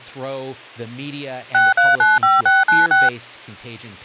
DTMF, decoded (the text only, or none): 6395696